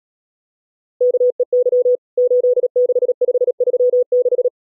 Morse code, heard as a keyed tone, machine-sent, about 37 wpm, 500 Hz. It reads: KEY 86536